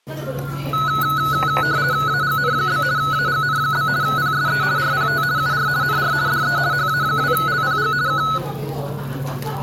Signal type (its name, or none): RTTY